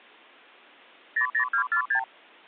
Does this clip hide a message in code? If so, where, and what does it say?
Yes: multi-frequency trunk signalling (R2, with the far end's replies) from 1.2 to 2.0 s, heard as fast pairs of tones, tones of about 90 ms. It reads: 00246